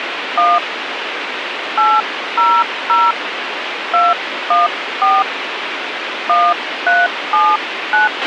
DTMF, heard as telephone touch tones, dialled by hand, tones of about 200 ms, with radio hiss and a squelch burst at the end. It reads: 1 800 214 1379